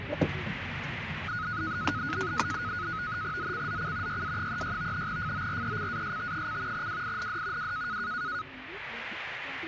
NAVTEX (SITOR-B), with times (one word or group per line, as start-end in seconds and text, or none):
3.4-4.2 ZCZC
4.1-5.1 YA36
5.1-6.9 FORECAST:
6.7-7.7 WIND
7.6-8.0 W